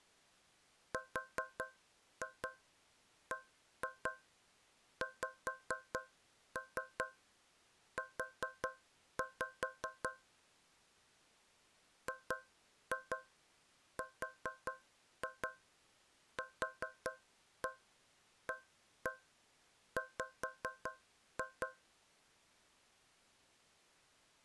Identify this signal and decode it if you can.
Tap code, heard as taps on a metal pipe, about 4 knocks a second. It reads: RBXU GRQAW